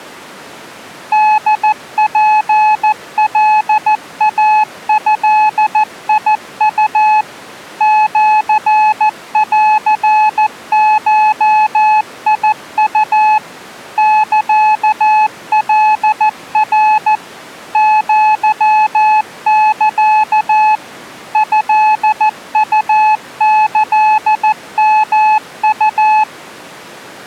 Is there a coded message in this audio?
Yes: Morse code (Japanese Wabun code) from 1.1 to 26.3 s, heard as a keyed tone, machine-sent, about 14 wpm, 860 Hz. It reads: ホツカイドウ シンゴウ サカナ アサ トウキヨウ